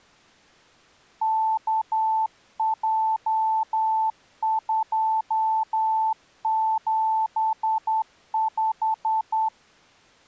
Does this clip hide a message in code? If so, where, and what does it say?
Yes: Morse code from 1.2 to 9.5 s, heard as a keyed tone, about 10 wpm, 880 Hz. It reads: KJ275